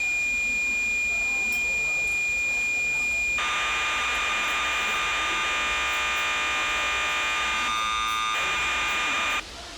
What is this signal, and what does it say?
Cassette data (Kansas City type), 1200 baud, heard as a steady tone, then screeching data, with the noise of a restaurant.